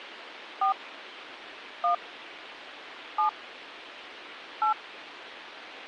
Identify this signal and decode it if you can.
DTMF, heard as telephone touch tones, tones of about 110 ms, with radio hiss. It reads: 4 1 7 8